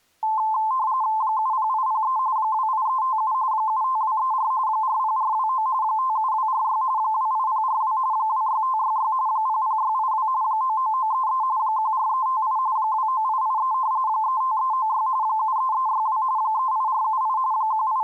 RTTY (45.45 baud, 170 Hz shift), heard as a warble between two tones, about 960 Hz centre. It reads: 70803 28357 75234 40429 57246 28042 26566 00682 99933 14358 29883 35396 73362 38478 …